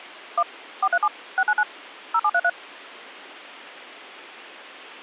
DTMF, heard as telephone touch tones, dialled by machine, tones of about 60 ms. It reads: 1 437 699 0733